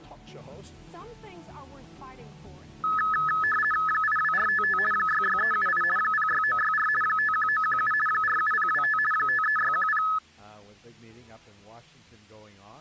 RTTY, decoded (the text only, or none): 82455 66378 06964 51917 47025 53610